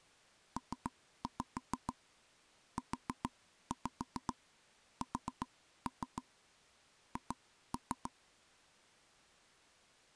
Tap code, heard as taps on a table, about 7 knocks a second. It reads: PUSH